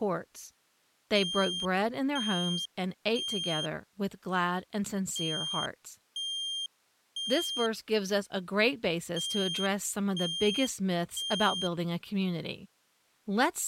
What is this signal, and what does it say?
Alarm pattern, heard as an alarm's beeps, played three times, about 3200 Hz, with speech in English. Temporal three. Smoke or fire, evacuate.